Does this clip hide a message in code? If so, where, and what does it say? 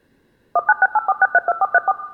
Yes: DTMF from 0.6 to 1.9 s, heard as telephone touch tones, dialled by machine, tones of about 40 ms, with room echo. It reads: 19684632434